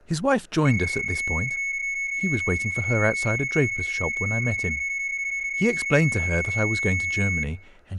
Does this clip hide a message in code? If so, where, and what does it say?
Yes: PSK31 (31.25 baud) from 0.7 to 7.4 s, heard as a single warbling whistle, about 2200 Hz, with speech in English.